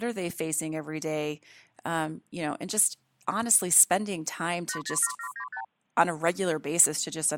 Multi-frequency trunk signalling (R2, with the far end's replies), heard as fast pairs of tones, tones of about 80 ms, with speech in English. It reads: 807795